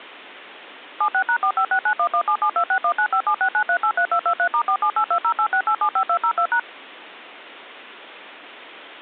DTMF, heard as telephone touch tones, dialled by machine, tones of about 80 ms. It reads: 76#4569117726195769383223*4782086875202#